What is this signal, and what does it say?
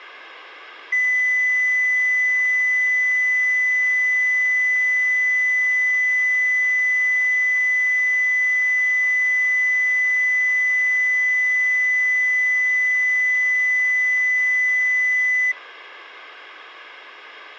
A steady tone, with room echo. There is no code.